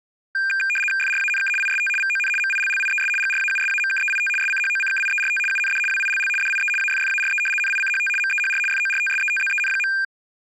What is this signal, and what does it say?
RTTY (75 baud, 850 Hz shift), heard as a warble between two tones, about 2000 Hz centre. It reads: FRANK IST VON MILLIES GRAUSAMKEIT SCHOCKIERT UND WILL DIE AFFARE NICHT MEHR FORTSETZEN.